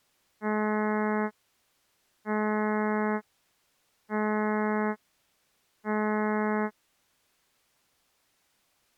Ship horn signal, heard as a ship's horn, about 210 Hz. 4 short. At sea: a pilot vessel's identity signal in fog.